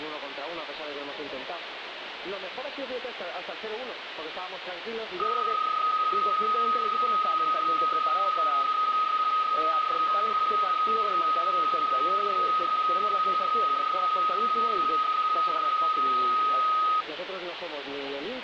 PSK31 (31.25 baud), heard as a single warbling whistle, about 1260 Hz, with radio static.